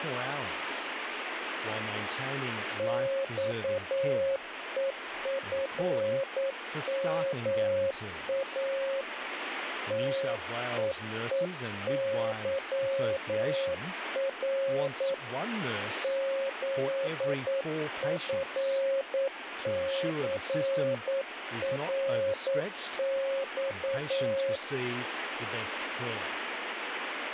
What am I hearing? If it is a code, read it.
Morse code, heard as a keyed tone, hand-sent with a paddle, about 9 wpm, 540 Hz, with radio static and speech in English. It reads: XEFMA TEEYR ZFCRX